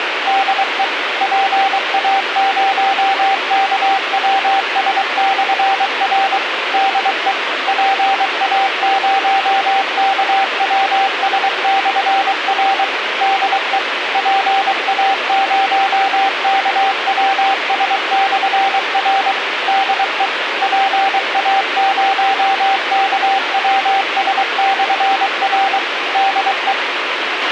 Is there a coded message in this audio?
Yes: Morse code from 0.2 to 26.8 s, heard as a keyed tone, machine-sent, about 23 wpm, 780 Hz, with radio hiss and a squelch burst at the end. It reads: DE PA0KWS/R DE PA0KWS/R DE PA0KWS/R DE PA0KWS/R DE